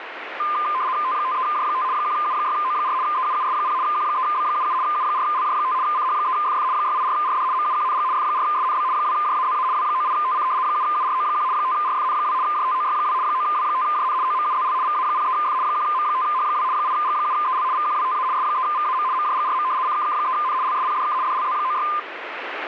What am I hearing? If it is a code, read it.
RTTY (75 baud, 170 Hz shift), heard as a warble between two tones, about 1120 Hz centre, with radio static. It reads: T53J5 1U6O4 EUUS0 Q3B77 U4LJ5 CH3FF 684RD MUQNG F4SNB 2JAZA W98TC 7URO1 5RFN2 JTOY2 9W5JN OMUZL VA03F 1M5H2 8G7EL VQWTA S3VAM MJGRM CKK3N LSPDK DLZ96